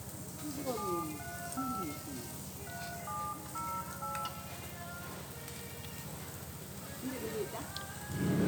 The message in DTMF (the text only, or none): 735 3708